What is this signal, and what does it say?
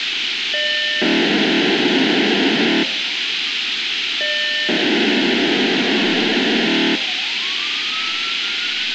POCSAG pager data (1200 baud), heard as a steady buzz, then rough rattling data, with radio hiss and street noise.